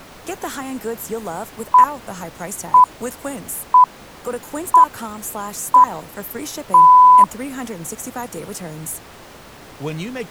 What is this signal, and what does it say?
Radio time signal (six pips, as the Greenwich Time Signal), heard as pips, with speech in English.